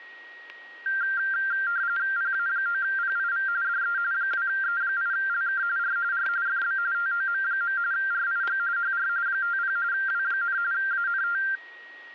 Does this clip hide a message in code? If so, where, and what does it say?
Yes: RTTY (45.45 baud, 170 Hz shift) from 0.9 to 11.6 s, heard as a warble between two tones, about 1480 Hz centre, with static crashes and a steady whistle near 1890 Hz. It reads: PA9PIV DE 2E8LK R R FB TOM. RIG HR 50 W, ANT